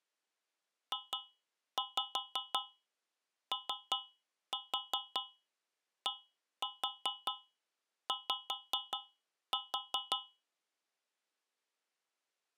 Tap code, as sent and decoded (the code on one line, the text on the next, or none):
2-5 3-4 1-4 5-4
JODY